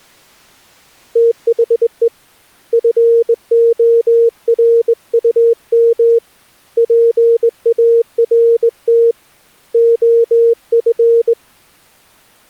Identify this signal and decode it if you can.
Morse code, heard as a keyed tone, hand-sent with a straight key, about 20 wpm, 460 Hz. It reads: THE FORUM PART OF